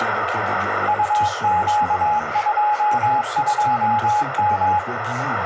Morse code, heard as a keyed tone, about 22 wpm, 840 Hz, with heavy radio static and a narrow filter. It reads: UQ22M